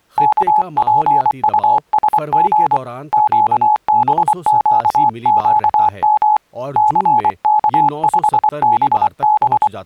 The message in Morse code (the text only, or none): KPUSG QBQQM CK5BB